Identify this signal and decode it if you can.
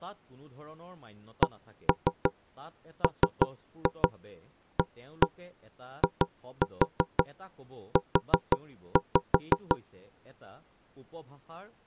Tap code, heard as knocks on wood, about 5 knocks a second, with speech in Assamese. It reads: CMAIU